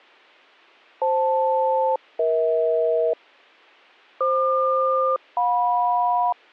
Aircraft SELCAL, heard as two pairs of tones. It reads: FL-EH FQ-JM